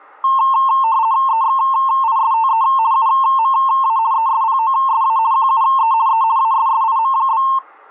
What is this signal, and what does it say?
RTTY (50 baud, 170 Hz shift), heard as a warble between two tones, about 980 Hz centre. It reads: EXISTE UMA ESPOSA QUE E ASSIM?